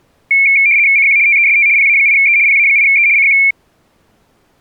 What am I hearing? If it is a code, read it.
RTTY (75 baud, 170 Hz shift), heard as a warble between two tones, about 2300 Hz centre. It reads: CQ TEST PA8E PA8E CQ